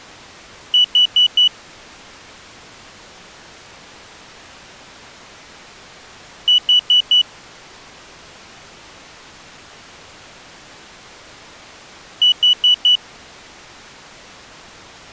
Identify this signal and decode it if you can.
Alarm pattern, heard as an alarm's beeps, played three times, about 2950 Hz. Temporal four. Carbon monoxide.